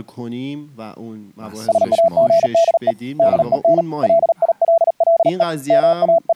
Morse code, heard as a keyed tone, hand-sent with a paddle, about 38 wpm, 670 Hz, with speech in Persian. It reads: SAGDE DEN LILLE …